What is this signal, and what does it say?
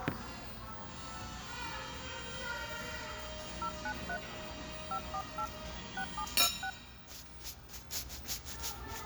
DTMF, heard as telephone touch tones, dialled by hand, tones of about 80 ms, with the noise of a restaurant. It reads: 093 548 6726